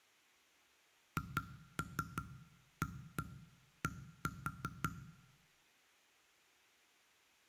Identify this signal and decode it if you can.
Tap code, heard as knocks on wood, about 5 knocks a second, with room echo. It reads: HAD